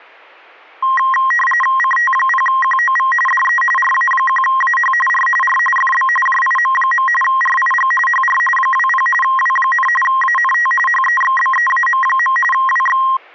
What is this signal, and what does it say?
RTTY (45.45 baud, 850 Hz shift), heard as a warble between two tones, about 1480 Hz centre. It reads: CT0QOV DE RA1AH R R FB JIM. RIG HR 20 W, ANT HEXBEAM. WX